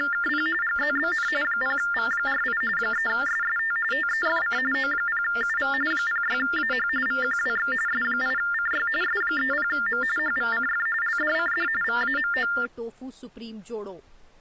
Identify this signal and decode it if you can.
TTY/TDD text telephone tones (45.45 baud Baudot), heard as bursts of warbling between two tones, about 400 Hz shift, 1600 Hz centre, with speech in Dogri. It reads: … GZBN 0V48 3SST TEFC O0UV 06AH VQWX S8CY S30M HVCF LDCD VAMO